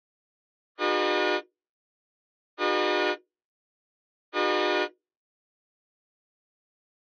Train horn signal, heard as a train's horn. 3 short. On North American railways: when stopped, the train will back up.